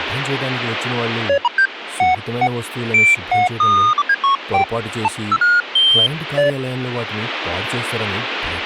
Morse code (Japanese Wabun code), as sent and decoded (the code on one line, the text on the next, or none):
none